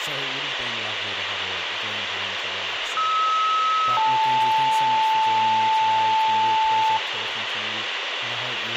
Two-tone page, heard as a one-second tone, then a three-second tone, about 1290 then 880 Hz, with radio hiss, a squelch burst at the end, room echo and speech in English.